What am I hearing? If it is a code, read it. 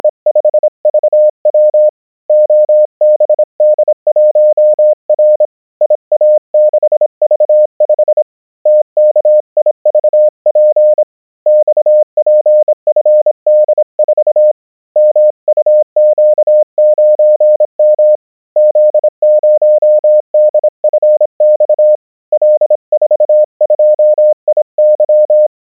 Morse code, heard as a keyed tone, hand-sent with a bug key, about 26 wpm, 610 Hz. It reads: … OBD1R IA6V5 TKIVP XPFD4 MUQ9M Z0DFX L42IY